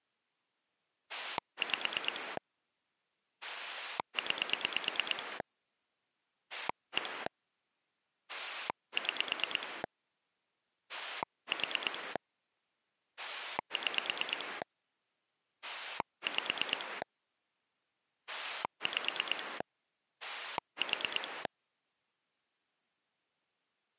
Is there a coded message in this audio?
Yes: pulse dialling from 1.1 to 21.5 s, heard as a rotary dial, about 9 pulses a second. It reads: 5 9 1 6 4 6 5 5 4